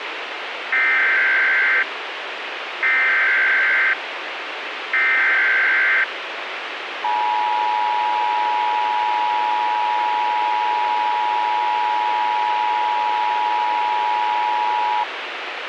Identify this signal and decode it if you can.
Emergency Alert System (SAME) tones (header bursts, then the 853 and 960 Hz attention tone), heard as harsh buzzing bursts, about 520.83 baud, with radio hiss.